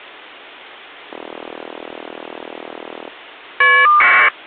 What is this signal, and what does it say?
Caller ID data burst, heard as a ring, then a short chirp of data, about 1200 baud.